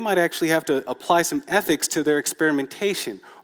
Speech in English. There is no code.